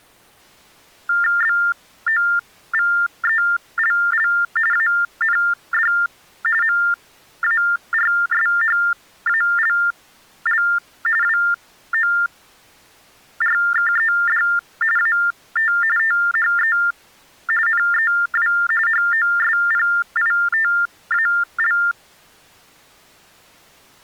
TTY/TDD text telephone tones (45.45 baud Baudot), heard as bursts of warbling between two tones, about 400 Hz shift, 1600 Hz centre. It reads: BOVELL AND MARSHALL WORKED AT THE NEW HOSPITAL